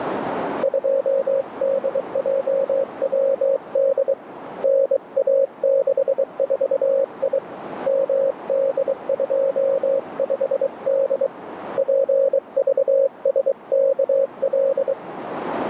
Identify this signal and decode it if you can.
Morse code, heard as a keyed tone, hand-sent with a bug key, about 23 wpm, 540 Hz, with radio static and a narrow filter. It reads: 2DJWD NA64I MD25D PVSKL